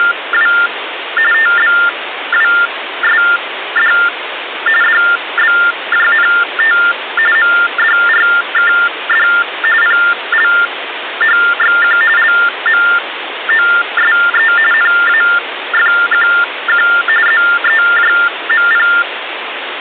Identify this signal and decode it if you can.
TTY/TDD text telephone tones (45.45 baud Baudot), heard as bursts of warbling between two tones, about 400 Hz shift, 1600 Hz centre, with phone line noise. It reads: … TBWSD DBJNT MDRKD PLHXQ LMOSE NAFQQ ZEJMP